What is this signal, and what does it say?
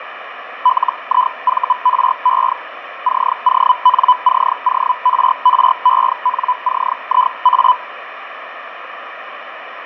Hellschreiber (Feld-Hell, 122.5 baud), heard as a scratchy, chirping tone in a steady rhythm, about 1000 Hz, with radio static and fading. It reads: LIVRE CONCORRENCIA